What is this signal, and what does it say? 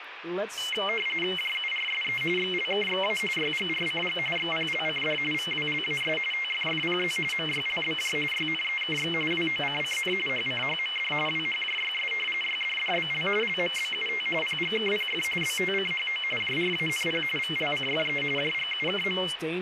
RTTY (45.45 baud, 850 Hz shift), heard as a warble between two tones, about 2550 Hz centre, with radio static and speech in English. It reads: JURSE XLKXA YGRCG XPLCD VWLAS TFFPZ MYLBJ YNEKX WOCCN HCHMD WHJYS YDDBL LMBUT PGKPF BTCHO JRANP VLCFE JGUKM